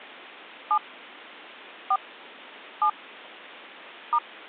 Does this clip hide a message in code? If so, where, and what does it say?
Yes: DTMF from 0.7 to 4.2 s, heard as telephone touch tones, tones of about 80 ms. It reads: 7 4 7 *